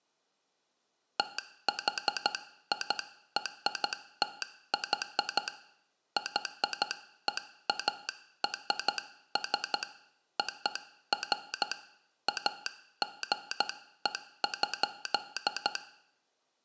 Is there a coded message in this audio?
Yes: Morse code (American railroad code) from 1.1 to 15.8 s, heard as a telegraph sounder, hand-sent with a straight key, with room echo. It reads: THIRTY YEARS OF AGE.